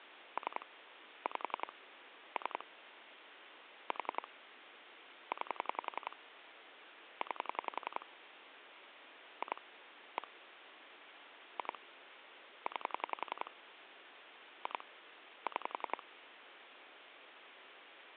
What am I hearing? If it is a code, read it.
Pulse dialling, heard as clicks on a phone line, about 11 pulses a second, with phone line noise. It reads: 3 5 3 4 9 9 2 1 2 9 2 6